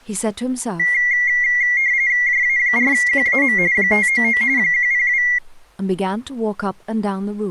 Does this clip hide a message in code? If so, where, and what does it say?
Yes: RTTY (45.45 baud, 170 Hz shift) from 0.8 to 5.4 s, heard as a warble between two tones, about 2050 Hz centre, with speech in English. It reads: JA4QAM 599 102